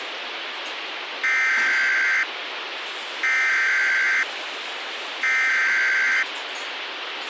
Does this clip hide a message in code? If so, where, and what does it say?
Yes: Emergency Alert System (SAME) tones (header bursts) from 1.2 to 6.2 s, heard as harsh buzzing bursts, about 520.83 baud, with radio hiss, a squelch burst at the end and kitchen noise.